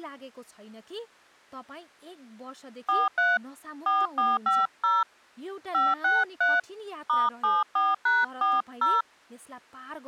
DTMF, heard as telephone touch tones, dialled by hand, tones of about 200 ms, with speech in Nepali. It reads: 43 4450 563 *74#40